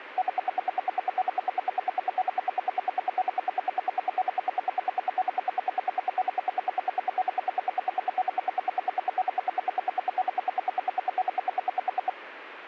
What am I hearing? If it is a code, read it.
Radio time signal (RWM, Moscow), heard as ten pulses a second.